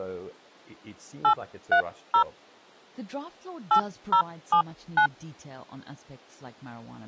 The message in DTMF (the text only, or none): 830 8079